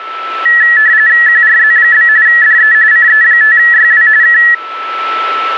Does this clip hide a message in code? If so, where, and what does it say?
Yes: RTTY (45.45 baud, 170 Hz shift) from 0.5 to 4.5 s, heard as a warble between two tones, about 1800 Hz centre, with a steady whistle near 1320 Hz. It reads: QRZ? DE CE5YW K